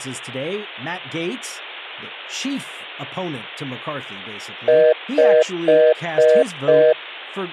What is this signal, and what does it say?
Telephone call progress tone (North American plan), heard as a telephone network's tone, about 480, 620 Hz, 0.25 s on and 0.25 s off, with speech in English. Congestion tone.